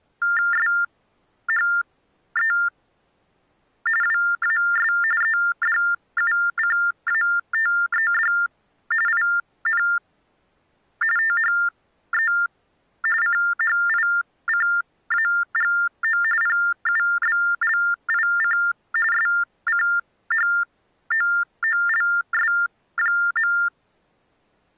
TTY/TDD text telephone tones (45.45 baud Baudot), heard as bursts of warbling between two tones, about 400 Hz shift, 1600 Hz centre. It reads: SHE WAS EDUCATED IN THE CHICAGO PUBLIC SCHOOLS.